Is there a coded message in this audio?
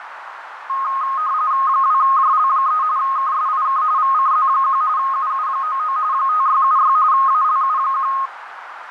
Yes: RTTY (45.45 baud, 170 Hz shift) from 0.7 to 8.3 s, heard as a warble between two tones, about 1160 Hz centre, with radio static and a narrow filter. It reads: 2JL3 KSIK VCZ1 UU99 5676 ALU1